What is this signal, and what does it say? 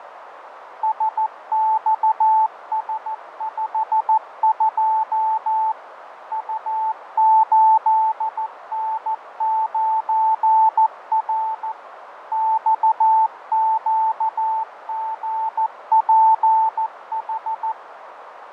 Morse code, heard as a keyed tone, machine-sent, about 14 wpm, 880 Hz, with radio static, fading and a narrow filter. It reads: SXS52 U8N9R XQGPH